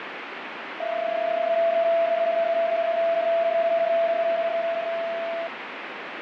PSK31 (31.25 baud), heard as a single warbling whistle, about 670 Hz, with radio static and fading.